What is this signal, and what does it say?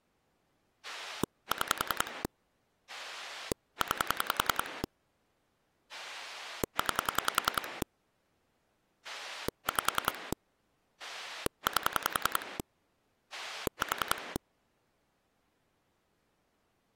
Pulse dialling, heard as a rotary dial, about 10 pulses a second. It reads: 6 9 9 5 8 4